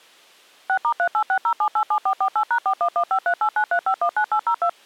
DTMF, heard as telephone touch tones, dialled by machine, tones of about 80 ms. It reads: 6*3860787448#41153893519802